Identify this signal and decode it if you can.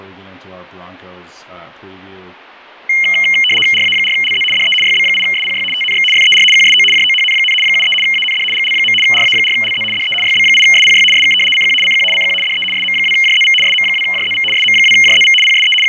RTTY (75 baud, 850 Hz shift), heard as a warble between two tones, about 2550 Hz centre, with fading and speech in English. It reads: RA4LZ DE YB8SPY TNX FER QSO JOHN, 73 AND GL. RA4LZ DE YB8SPY SK CQ CQ CQ DE SM2JZV SM2JZV SM2JZV PSE …